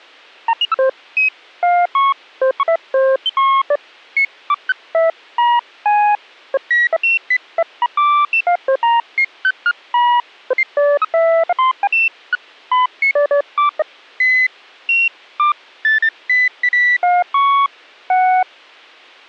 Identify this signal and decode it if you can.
Electronic bleeps of random pitch and length. There is no code.